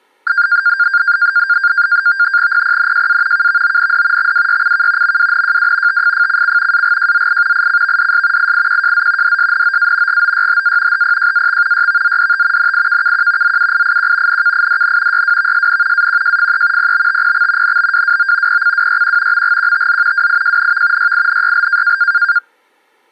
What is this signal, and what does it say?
NAVTEX (SITOR-B), 100 baud, 170 Hz shift, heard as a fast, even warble, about 1500 Hz centre. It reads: PPNJA KVOND XWYCK MWNJW TFFCC AGJZI ICVDS IIQJZ DSNOA GOYHA HPJAX YVZDT NIKKQ ZUIIQ NKIDN YWVSN AQJFE PBTPX NBWWO PCWYQ MGQTZ WIJNV YINYL